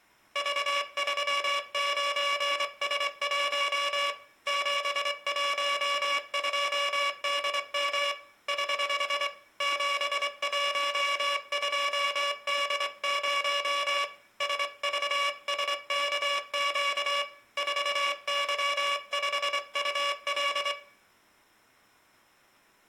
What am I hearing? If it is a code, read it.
Morse code, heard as a buzzer, hand-sent with a straight key, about 24 wpm, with room echo. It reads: V39S1 712DM <HH> 712D0 SVSKQ 4Y5UL